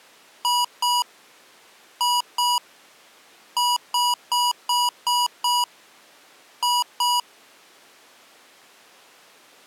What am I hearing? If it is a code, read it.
Beep code, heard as beeps from a small speaker, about 970 Hz. 2-2-6-2.